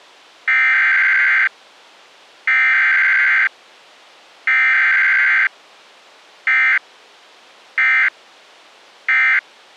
Emergency Alert System (SAME) tones (header bursts, then end-of-message bursts), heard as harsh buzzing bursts, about 520.83 baud.